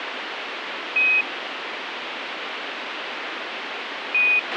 Quindar tones, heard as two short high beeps, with radio hiss and a squelch burst at the end.